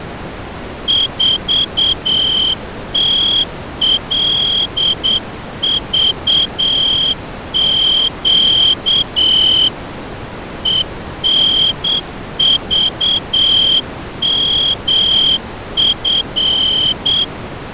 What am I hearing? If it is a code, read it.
Morse code, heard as a whistle, hand-sent with a straight key, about 8 wpm. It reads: 4TLVQ ENVMF